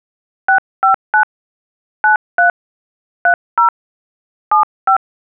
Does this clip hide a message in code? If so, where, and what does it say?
Yes: DTMF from 0.5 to 5.0 s, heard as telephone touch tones, dialled by hand, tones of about 100 ms. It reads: 659 93 30 75